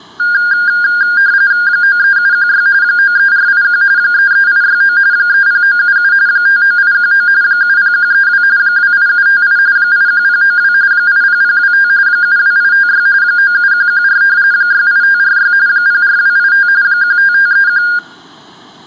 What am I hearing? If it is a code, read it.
RTTY (45.45 baud, 170 Hz shift), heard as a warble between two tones, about 1500 Hz centre, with room echo. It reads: 93716 93481 33869 30977 59819 70132 28758 81092 80025 72856 97114 68546 04285 15531